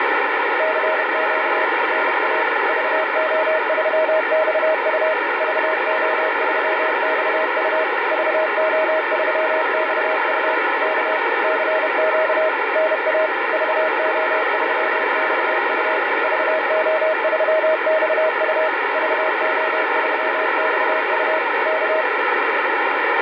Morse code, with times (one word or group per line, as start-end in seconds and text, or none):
0.6-1.6 CQ
1.9-2.4 NA
2.7-5.1 VO3XU
5.4-7.8 VO3XU
8.1-10.5 VO3XU
10.8-11.2 K
11.4-12.5 CQ
12.8-13.3 NA
13.5-16.0 VO3XU
16.2-18.7 VO3XU
18.9-21.4 VO3XU
21.7-22.0 K